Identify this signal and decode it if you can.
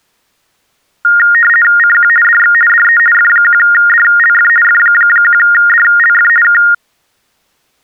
RTTY (50 baud, 450 Hz shift), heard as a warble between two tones, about 1650 Hz centre. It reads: CQ DX DE F1DLF F1DLF K